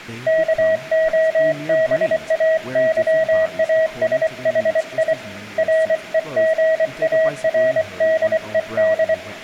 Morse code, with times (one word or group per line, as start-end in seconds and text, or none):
0.3-5.1 KOBAYASHI
5.6-9.1 REGARDED